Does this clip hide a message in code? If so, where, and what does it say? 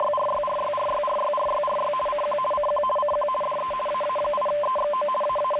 Yes: RTTY (50 baud, 450 Hz shift) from 0.0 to 5.6 s, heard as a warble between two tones, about 810 Hz centre, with radio static. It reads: … CQ CQ CQ DE AA8EXO …